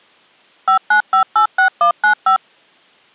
DTMF, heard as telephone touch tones, dialled by machine, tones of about 100 ms. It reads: 59586195